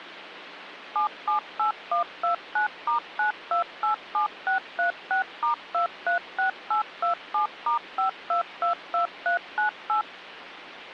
DTMF, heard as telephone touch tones, dialled by machine, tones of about 110 ms, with phone line noise. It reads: 778129*9287636*236827*5222398